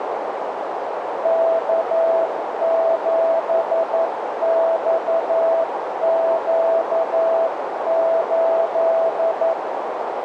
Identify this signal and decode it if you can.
Morse code, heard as a keyed tone, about 11 wpm, 660 Hz, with heavy radio static and a narrow filter. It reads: K7XQ8